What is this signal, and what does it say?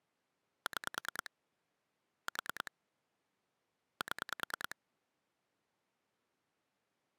Pulse dialling, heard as clicks on a phone line, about 9 pulses a second. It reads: 6 4 7